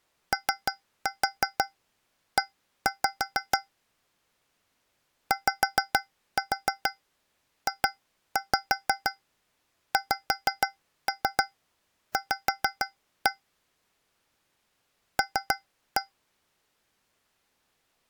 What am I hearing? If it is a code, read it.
Tap code, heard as taps on a metal pipe, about 6 knocks a second. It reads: OE YJXV L